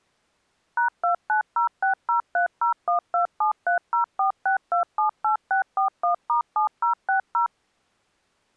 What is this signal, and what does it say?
DTMF, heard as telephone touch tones, dialled by machine, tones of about 110 ms. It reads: #29060301273046278641*7060